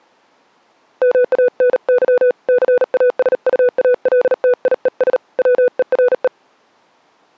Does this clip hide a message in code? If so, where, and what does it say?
Yes: Morse code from 1.0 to 6.3 s, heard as a keyed tone, hand-sent with a paddle, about 38 wpm, 490 Hz. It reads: MANY CASUALTIES WERE